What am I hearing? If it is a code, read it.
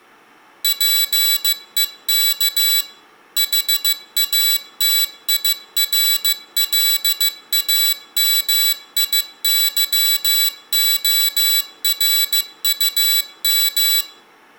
Morse code, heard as a high beeper, machine-sent, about 15 wpm, 3950 Hz, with room echo. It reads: PEK HATIRLAMIYORUM